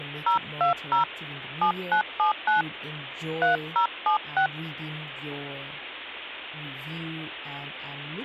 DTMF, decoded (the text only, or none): 020 7979 3076